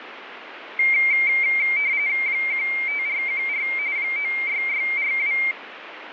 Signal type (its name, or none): RTTY